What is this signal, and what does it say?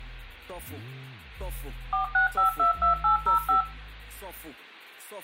DTMF, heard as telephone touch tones, dialled by machine, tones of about 120 ms, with room echo. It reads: 46522805